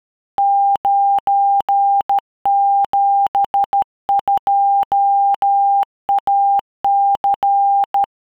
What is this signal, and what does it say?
Morse code, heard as a keyed tone, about 13 wpm, 800 Hz. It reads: 972AC